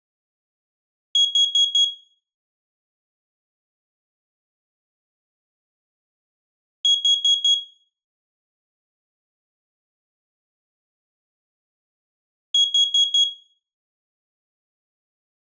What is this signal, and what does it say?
Alarm pattern, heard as an alarm's beeps, played three times, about 3300 Hz, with room echo. Temporal four. Carbon monoxide.